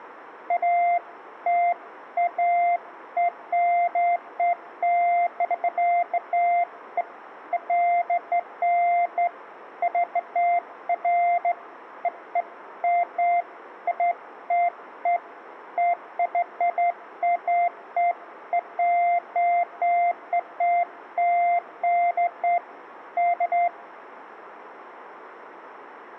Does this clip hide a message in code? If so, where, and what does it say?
No, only beeps of irregular length.